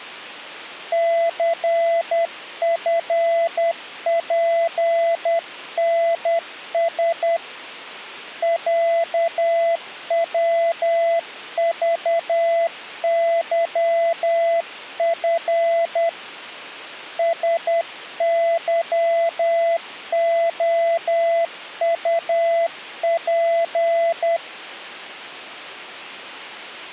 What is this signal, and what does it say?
Morse code (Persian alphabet), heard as a keyed tone, hand-sent with a paddle, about 10 wpm, 670 Hz. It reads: ثفپنس صوذظف سظعطپ